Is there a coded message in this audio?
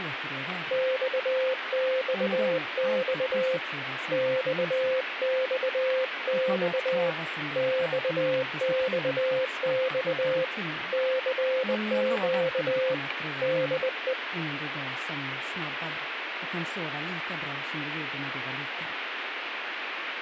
Yes: Morse code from 0.7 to 14.2 s, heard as a keyed tone, hand-sent with a bug key, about 20 wpm, 520 Hz, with radio static. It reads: XXX XXX XXX CQ DE